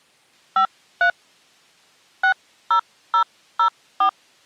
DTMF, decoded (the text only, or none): 53 60004